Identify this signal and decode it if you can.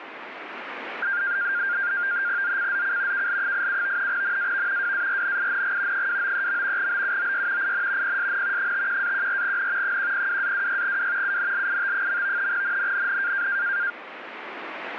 NAVTEX (SITOR-B), 100 baud, 170 Hz shift, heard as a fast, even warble, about 1500 Hz centre, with radio static. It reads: ZCZC KL87 NAV WARNING 293. BUOY IN PSN 51-14N 102-26W UNLIT. NNNN